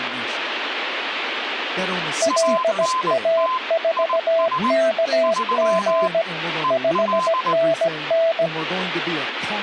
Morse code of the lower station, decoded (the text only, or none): LA4KG 5NN